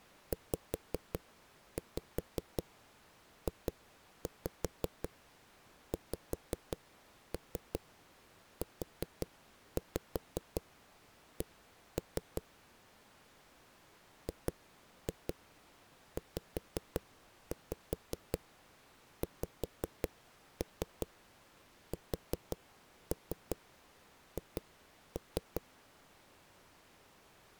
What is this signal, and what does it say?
Tap code, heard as knocks on a wall, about 5 knocks a second. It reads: ZJXUC GZXSH